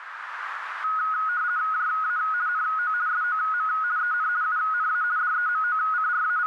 RTTY (50 baud, 170 Hz shift), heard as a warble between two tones, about 1360 Hz centre, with radio static and a narrow filter. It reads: JA NO SOM EN UNA …